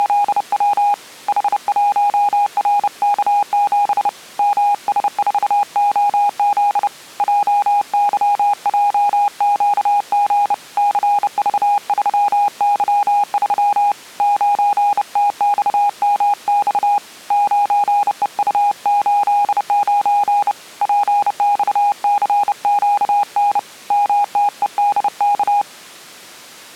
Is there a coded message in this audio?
Yes: Morse code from 0.0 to 25.7 s, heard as a keyed tone, hand-sent with a bug key, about 30 wpm, 820 Hz. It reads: … H1RK7 MS4OZ JYJQG CV3Y3 9TXMX 9EU89 PXCQN MTEDK